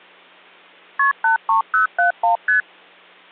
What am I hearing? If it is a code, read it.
Multi-frequency trunk signalling (R1, as on North American trunks), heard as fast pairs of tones, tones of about 120 ms. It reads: KP 83071 ST